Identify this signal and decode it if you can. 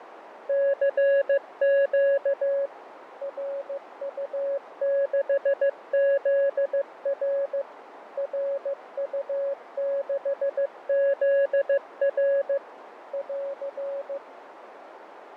Morse code, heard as a keyed tone, machine-sent, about 15 wpm, 560 Hz, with radio static, fading and a narrow filter. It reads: CQ RU6ZR RU6ZR <AR>